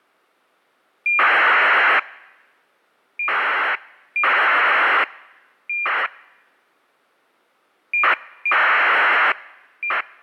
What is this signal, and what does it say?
ACARS aircraft data, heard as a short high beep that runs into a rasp, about 2400 baud.